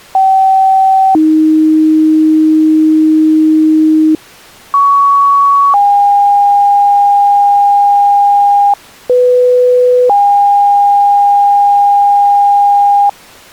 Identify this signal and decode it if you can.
Two-tone page, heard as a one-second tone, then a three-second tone, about 770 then 310 Hz, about 1120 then 810 Hz, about 500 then 810 Hz.